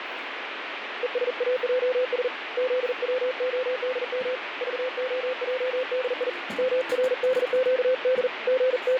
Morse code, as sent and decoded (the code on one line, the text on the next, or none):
. ... .- .--- ... / --.. .-- --- -.. -- / ...- --- .--- -.. .. / -- .-. -.. --.- -.. / …
ESAJS ZWODM VOJDI MRDQD …